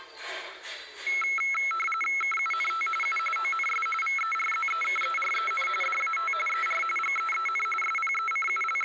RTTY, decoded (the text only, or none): KUNT U ONS VERZEKEREN DAT ER GEEN …